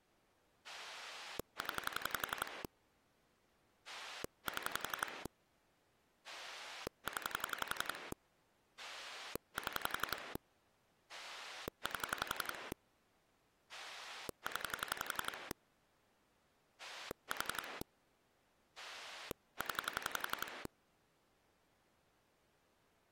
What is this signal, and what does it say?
Pulse dialling, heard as a rotary dial, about 11 pulses a second. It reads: 0 7 0 7 8 0 4 0